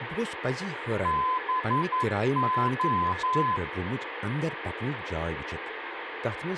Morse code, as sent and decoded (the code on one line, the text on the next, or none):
-... ---
BO